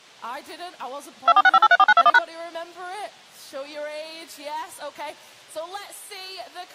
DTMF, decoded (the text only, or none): 2465834921#